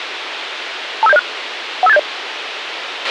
Five-tone selective call (EIA), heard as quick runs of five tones, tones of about 30 ms, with radio hiss and a squelch burst at the end. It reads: 25706 15870